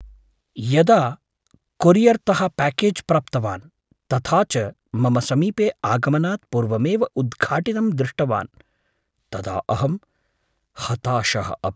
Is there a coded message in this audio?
No, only speech in Sanskrit.